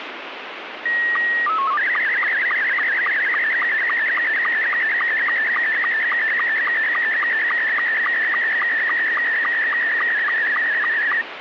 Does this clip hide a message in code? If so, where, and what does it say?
Yes: SSTV (slow-scan television), Scottie S2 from 0.9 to 11.2 s, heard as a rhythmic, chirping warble, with radio static.